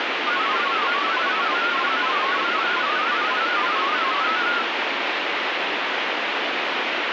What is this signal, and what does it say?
Multi-tone FSK (Olivia or MFSK type), about 500 Hz wide, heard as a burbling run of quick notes, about 31.25 baud, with heavy radio static.